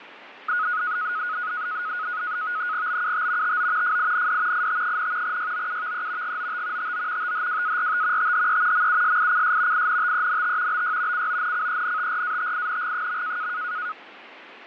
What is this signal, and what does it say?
NAVTEX (SITOR-B), 100 baud, 170 Hz shift, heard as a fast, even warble, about 1360 Hz centre, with radio static and fading. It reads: BUT TO FIND IT, YOUVE GOT TO THWART THE MUSICS INTENT BY CONCENTRATING.